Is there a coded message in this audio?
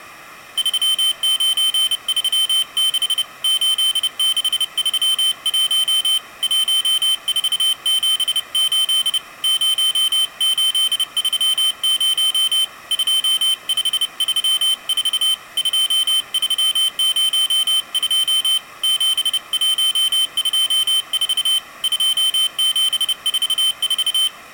Yes: Morse code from 0.5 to 24.3 s, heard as a high beeper, hand-sent with a paddle, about 30 wpm, 3100 Hz. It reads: 3936 8631 1478 0830 2534 2302 7124 2744